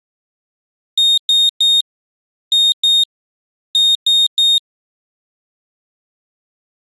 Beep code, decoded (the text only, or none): 3-2-3